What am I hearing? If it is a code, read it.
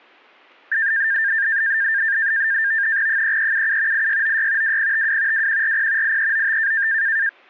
NAVTEX (SITOR-B), 100 baud, 170 Hz shift, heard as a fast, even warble, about 1700 Hz centre, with static crashes. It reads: 3377 8696 2052 2140 8395